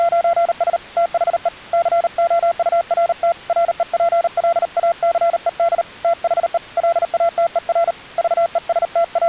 Morse code, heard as a keyed tone, hand-sent with a paddle, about 38 wpm, 680 Hz. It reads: … THE COURT REPLACED THE LATER …